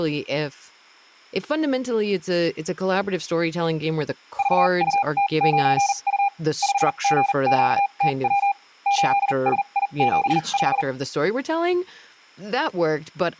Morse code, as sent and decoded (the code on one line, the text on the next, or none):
...- ..- - ----. ..- / ..... --. --.- - .-- / ---.. ... .. --... .....
VUT9U 5GQTW 8SI75